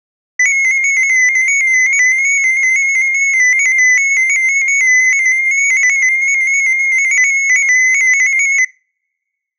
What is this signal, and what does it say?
Multi-tone FSK (Olivia or MFSK type), about 250 Hz wide, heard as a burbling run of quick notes, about 15.625 baud, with room echo.